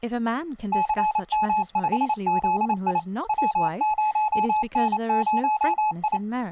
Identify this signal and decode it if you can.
Morse code, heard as a keyed tone, machine-sent, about 28 wpm, 860 Hz, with speech in English. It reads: CM5ZI W0N0I